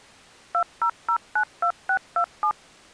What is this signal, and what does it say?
DTMF, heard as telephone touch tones, dialled by machine, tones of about 80 ms. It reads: 20092627